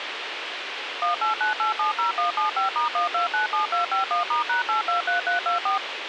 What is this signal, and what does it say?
DTMF, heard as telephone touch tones, dialled by machine, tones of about 130 ms, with radio hiss and a squelch burst at the end. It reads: 189870175*1297251*#823324